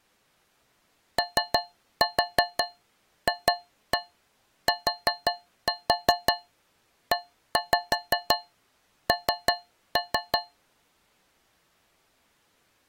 Tap code, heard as taps on a metal pipe, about 5 knocks a second. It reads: OFTEN